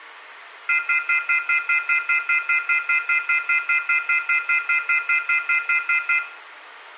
Telephone call progress tone (North American plan), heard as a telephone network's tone, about 1400, 2050, 2450, 2600 Hz, 0.1 s on and 0.1 s off, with room echo. Off-hook warning tone.